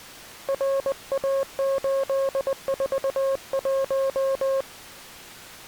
Morse code, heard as a keyed tone, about 20 wpm, 540 Hz. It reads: RA841